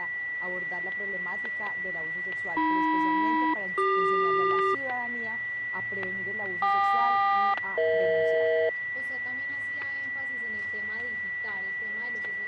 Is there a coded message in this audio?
Yes: aircraft SELCAL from 2.6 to 8.7 s, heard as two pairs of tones, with static crashes and a steady whistle near 1960 Hz. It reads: AM-CQ KQ-EH